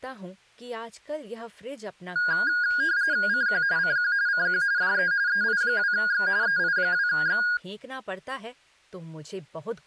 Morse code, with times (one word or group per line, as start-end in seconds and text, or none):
none